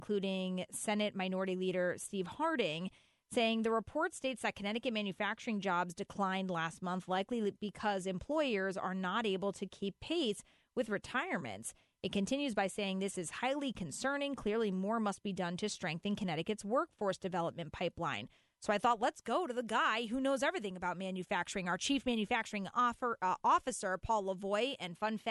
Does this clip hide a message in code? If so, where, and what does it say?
No.